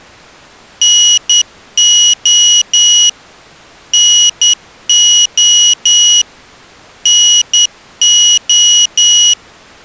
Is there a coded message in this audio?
Yes: Morse code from 0.8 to 9.4 s, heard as a high beeper, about 10 wpm, 2900 Hz. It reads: NO NO NO